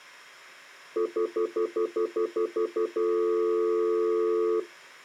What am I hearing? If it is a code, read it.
Telephone call progress tone (North American plan), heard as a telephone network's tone, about 350, 440 Hz, 0.1 s on and 0.1 s off. Stutter dial tone.